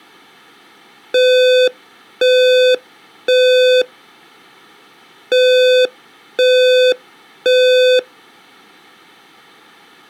Alarm pattern, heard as an alarm's beeps, played twice, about 510 Hz. Temporal three. Smoke or fire, evacuate.